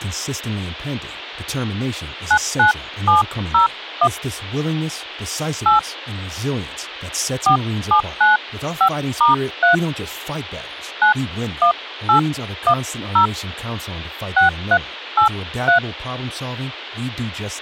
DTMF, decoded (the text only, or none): 99701 8 4795*3 91810 6383